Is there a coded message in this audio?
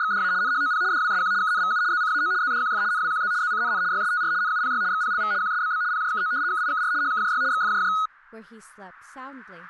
Yes: RTTY (75 baud, 170 Hz shift) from 0.0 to 8.1 s, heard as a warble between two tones, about 1360 Hz centre, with speech in English. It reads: … NHOP DWSQ KNVU ZCAO ZDQF NWQZ ZCNN YSTR NUPY XPLV QSBB PJKO KIKR HKJY XFJJ